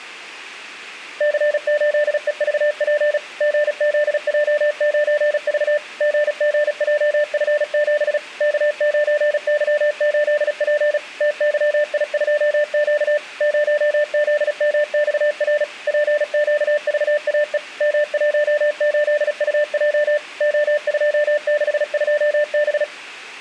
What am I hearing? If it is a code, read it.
Morse code, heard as a keyed tone, machine-sent, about 36 wpm, 590 Hz, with room echo. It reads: C8EVP GZJ9V GGJF7 K9Y8P TYI2Q 0ZMXR PQVAE M18UJ O262B